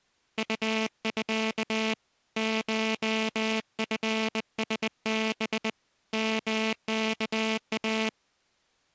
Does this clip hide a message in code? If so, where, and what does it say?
Yes: Morse code (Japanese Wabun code) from 0.3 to 8.1 s, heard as a buzzer, hand-sent with a bug key, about 20 wpm. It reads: ウミ コチラハ ヨワイ